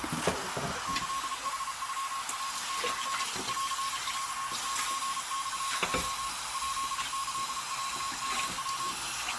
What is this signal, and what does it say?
Morse code (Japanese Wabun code), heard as a keyed tone, machine-sent, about 33 wpm, 1090 Hz, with heavy radio static, a narrow filter and kitchen noise. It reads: キヌノナシ ンンルモレ ヱキロヨヤ